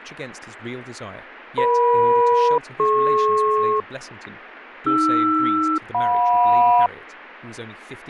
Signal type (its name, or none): aircraft SELCAL